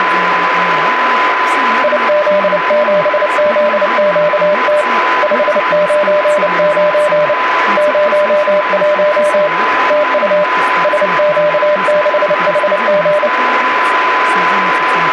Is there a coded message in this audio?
Yes: Morse code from 1.8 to 13.3 s, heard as a keyed tone, hand-sent with a paddle, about 29 wpm, 600 Hz, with radio static, a steady whistle near 1010 Hz and speech in Russian. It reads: IZ7ZQT 599 01 TU SQ6HG